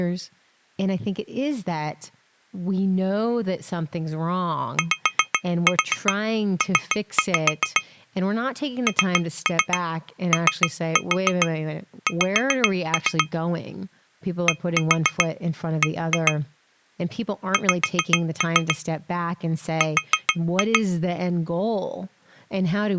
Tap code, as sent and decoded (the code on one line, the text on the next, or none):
5-4 3-5 / 3-3 3-4 5-3 / 1-4 1-2 / 5-3 / 4-2
YP NOX DB X R